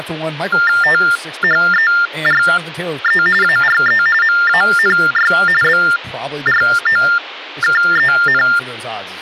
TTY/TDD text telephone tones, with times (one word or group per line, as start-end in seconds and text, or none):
0.8-3.2 THERE
3.4-4.0 ARE
4.2-5.3 MANY
5.6-8.4 BROKEN